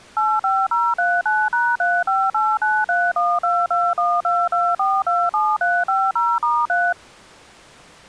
DTMF, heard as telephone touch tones, dialled by machine, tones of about 230 ms. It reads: 85039#35893122122427350*3